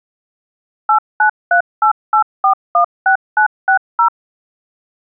DTMF, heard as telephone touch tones, dialled by machine, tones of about 100 ms. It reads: 89388416960